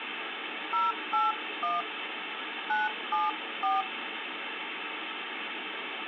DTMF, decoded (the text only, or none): 081 974